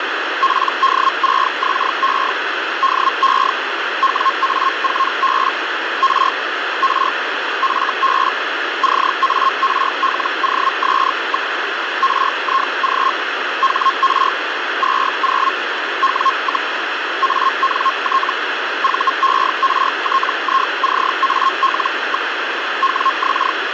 Hellschreiber (Feld-Hell, 122.5 baud), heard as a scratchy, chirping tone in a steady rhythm, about 1070 Hz, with radio static. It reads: PD6XE DE WA4B R R FB CARLOS. RIG HR 20 W, ANT VERTICAL. WX